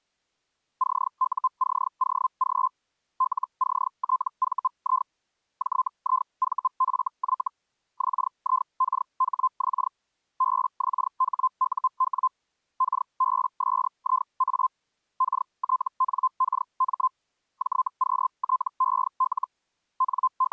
Hellschreiber (Feld-Hell, 122.5 baud), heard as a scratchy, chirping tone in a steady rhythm, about 1040 Hz. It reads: CUCOG LCTVI JIVFY XIKHX BXHUW KBSIA KTNKM JQTEL …